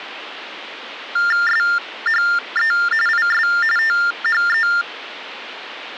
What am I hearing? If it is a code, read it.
TTY/TDD text telephone tones (45.45 baud Baudot), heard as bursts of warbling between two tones, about 400 Hz shift, 1600 Hz centre. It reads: SHE IS THE